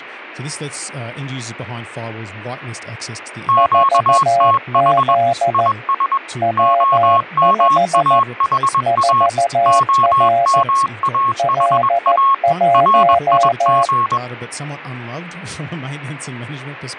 Morse code, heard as two keyed tones, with speech in English. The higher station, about 21 wpm, 1090 Hz: QTH IS OMAHA OMAHA RIG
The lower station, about 14 wpm, 690 Hz: 4Z W5 4R L1